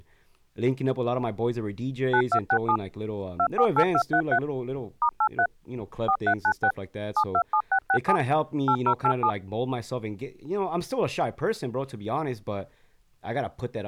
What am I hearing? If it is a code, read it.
DTMF, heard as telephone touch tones, dialled by machine, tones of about 70 ms, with speech in English. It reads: 9267 248233 *83 4396 727667 8087